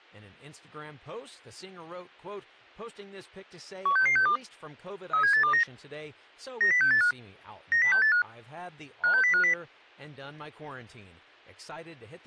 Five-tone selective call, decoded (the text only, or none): 16662 37829 90685 90685 56050